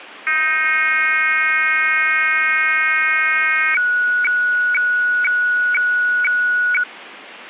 Weather fax (radiofax), 120 lines a minute, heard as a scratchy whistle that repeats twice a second.